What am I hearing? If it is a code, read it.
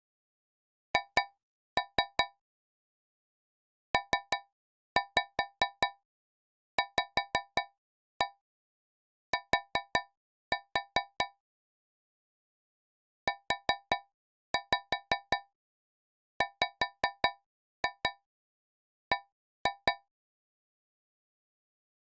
Tap code, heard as taps on a metal pipe, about 5 knocks a second. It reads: H PVT UWB